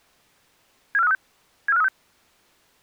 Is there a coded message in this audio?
Yes: five-tone selective call (EEA) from 0.9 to 1.9 s, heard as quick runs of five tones, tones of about 40 ms. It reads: 74536 74536